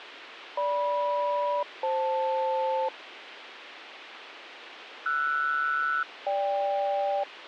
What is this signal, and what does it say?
Aircraft SELCAL, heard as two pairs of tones, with radio hiss. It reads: GM-FL RS-GK